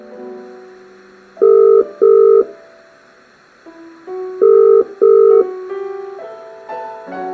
Telephone call progress tone (as in the UK, Ireland, Australia and similar networks), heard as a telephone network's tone, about 400, 450 Hz, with room echo. Ringback tone.